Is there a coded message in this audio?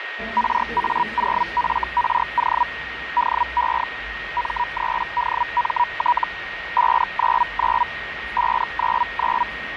Yes: Hellschreiber (Feld-Hell, 122.5 baud) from 0.4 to 9.4 s, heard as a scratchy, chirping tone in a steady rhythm, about 970 Hz, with radio static, a steady whistle near 1870 Hz and the noise of a subway station. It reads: RA0FRO DE M3DMT 599 599